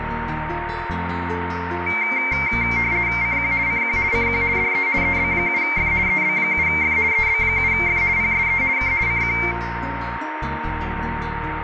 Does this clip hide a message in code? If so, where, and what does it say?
Yes: RTTY (50 baud, 170 Hz shift) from 1.9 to 9.5 s, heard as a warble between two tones, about 2200 Hz centre, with radio static, a steady whistle near 920 Hz and room echo. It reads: CQ CQ CQ DE EB7F EB7F EB7F PSE K CQ